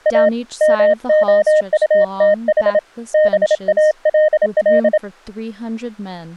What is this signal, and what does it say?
Morse code, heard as a keyed tone, hand-sent with a paddle, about 27 wpm, 620 Hz, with speech in English. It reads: A MOUTH BALL